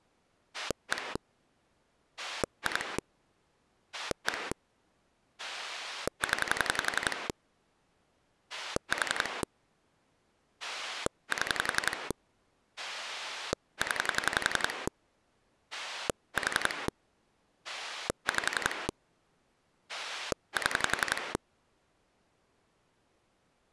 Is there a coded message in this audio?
Yes: pulse dialling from 0.5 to 21.4 s, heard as a rotary dial, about 11 pulses a second. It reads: 1 2 1 0 4 7 0 4 5 7